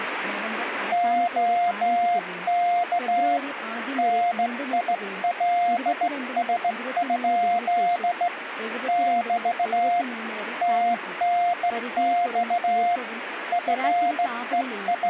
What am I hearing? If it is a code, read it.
Morse code, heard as a keyed tone, hand-sent with a straight key, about 16 wpm, 700 Hz, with radio static and speech in Malayalam. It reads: OK NILS? <BT> TNX …